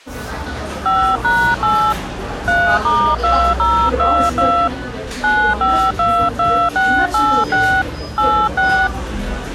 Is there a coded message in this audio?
Yes: DTMF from 0.9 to 8.9 s, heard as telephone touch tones, dialled by hand, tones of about 300 ms, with the noise of a cafe. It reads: 5#8 3*2022 9522686 86